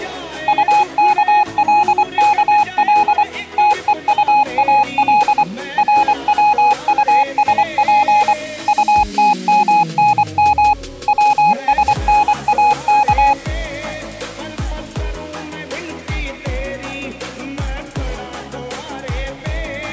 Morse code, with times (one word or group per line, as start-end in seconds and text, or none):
0.5-3.2 UKLKL
3.6-5.4 TEUAL
5.8-8.3 RWUSP
8.7-10.7 UTMNM
11.1-13.3 WSNAK